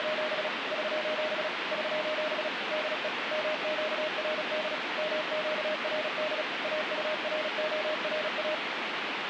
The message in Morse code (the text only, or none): … <SOS> <SOS> DE MQRD MQRD AURORA